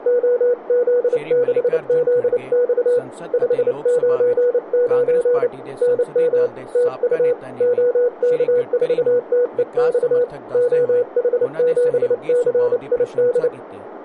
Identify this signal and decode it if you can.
Morse code, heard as a keyed tone, hand-sent with a paddle, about 29 wpm, 490 Hz, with radio static and speech in Punjabi. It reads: OZ6ZX 599 NM TU OK4TEX OH7CID